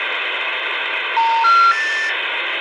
Telephone call progress tone (North American plan), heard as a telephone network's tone, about 910, 1370, 1800 Hz, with phone line noise. Special information tone.